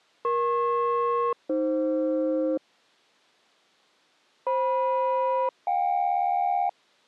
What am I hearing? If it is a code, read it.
Aircraft SELCAL, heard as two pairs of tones. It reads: EP-AF FM-JK